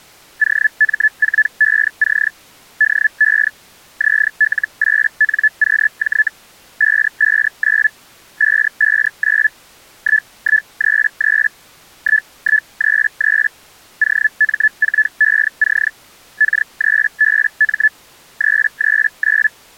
Hellschreiber (Feld-Hell, 122.5 baud), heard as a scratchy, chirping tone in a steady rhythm, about 1750 Hz. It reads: OM4EC DE ZL8NQJ 559 559 1133 1133 OM4EC K3BM 339